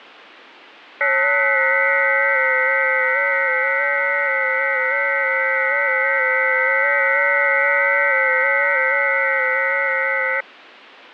FT8 (several signals at once), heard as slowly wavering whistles, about 6.25 baud, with radio static.